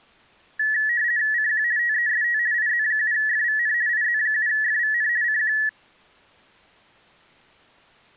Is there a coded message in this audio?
Yes: RTTY (50 baud, 170 Hz shift) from 0.6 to 5.7 s, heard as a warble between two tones, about 1800 Hz centre. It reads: CQ TEST IZ7FVN IZ7FVN CQ